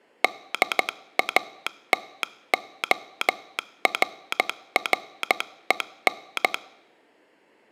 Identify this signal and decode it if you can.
Morse code, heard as a telegraph sounder, hand-sent with a paddle, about 14 wpm. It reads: DATORREN